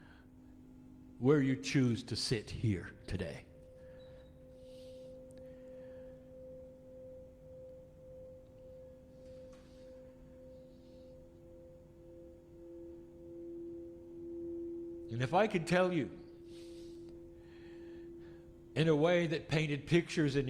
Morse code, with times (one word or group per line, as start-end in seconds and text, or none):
none